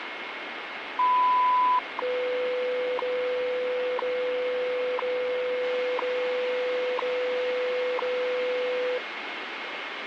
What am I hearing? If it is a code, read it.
Radio time signal (WWV, Colorado), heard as ticks, one a second, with radio static.